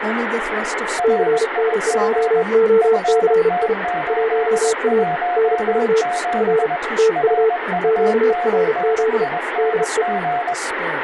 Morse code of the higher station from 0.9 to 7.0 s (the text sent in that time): RIG FT817